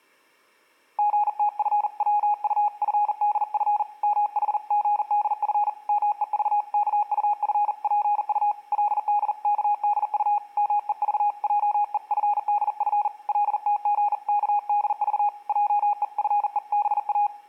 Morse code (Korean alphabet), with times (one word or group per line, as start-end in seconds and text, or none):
1.0-3.8 선비는
4.0-5.7 무슨
5.9-8.5 말인지
8.7-10.4 그의
10.6-13.1 말하는
13.3-15.3 것을
15.5-17.3 하나도